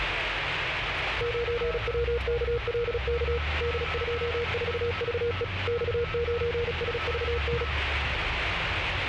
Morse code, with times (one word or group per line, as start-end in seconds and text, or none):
1.2-3.4 9WKLK
3.6-5.4 D24VE
5.7-7.6 X9SVN